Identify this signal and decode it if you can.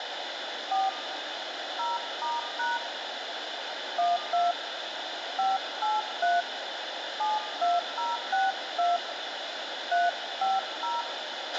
DTMF, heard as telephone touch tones, dialled by hand, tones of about 180 ms, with radio hiss, a squelch burst at the end and room echo. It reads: 4 0*# 12 583 72062 350